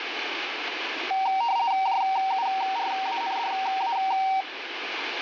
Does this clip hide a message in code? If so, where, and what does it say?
Yes: RTTY (50 baud, 170 Hz shift) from 1.1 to 4.4 s, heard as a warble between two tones, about 850 Hz centre, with radio static. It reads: JURANDA